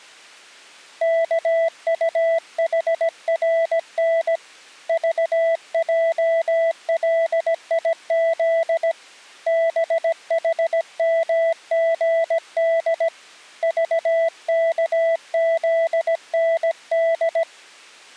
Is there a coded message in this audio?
Yes: Morse code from 1.0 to 17.5 s, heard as a keyed tone, hand-sent with a paddle, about 17 wpm, 660 Hz. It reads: KUHRN VJLIZ BHMGD VKZND